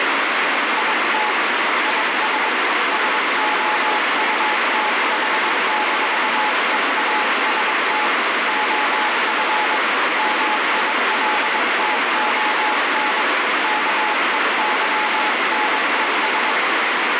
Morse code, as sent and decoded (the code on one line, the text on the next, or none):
.. - / .. ... / ... --- ..- - .... -....- . .- ... - / --- ..-. / -- .. .-.. - --- -. / -.- . -.-- -. . ...
IT IS SOUTH-EAST OF MILTON KEYNES